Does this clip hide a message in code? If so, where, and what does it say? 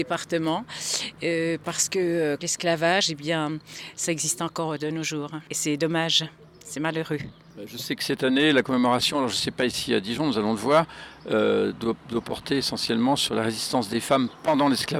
No.